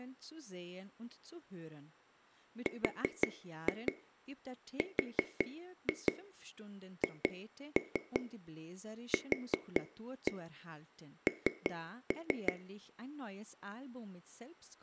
Tap code, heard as taps on a table, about 5 knocks a second, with speech in German. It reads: RRHQN